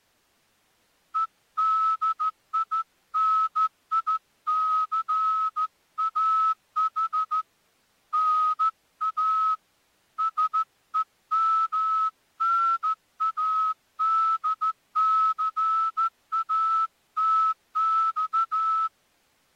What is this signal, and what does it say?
Morse code (Russian alphabet), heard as a whistle, hand-sent with a straight key, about 14 wpm. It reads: ЕДИНИЦАХ НА СЕМНАДЦАТЬ